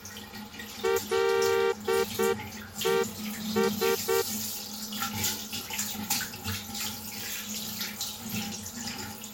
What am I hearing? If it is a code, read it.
Morse code, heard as a horn, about 9 wpm, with the noise of a restroom. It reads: LES